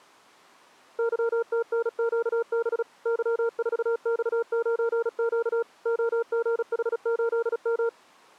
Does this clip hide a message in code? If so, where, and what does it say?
Yes: Morse code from 0.9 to 7.9 s, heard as a keyed tone, machine-sent, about 36 wpm, 460 Hz. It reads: YTNQB Y4X9Q OGH8M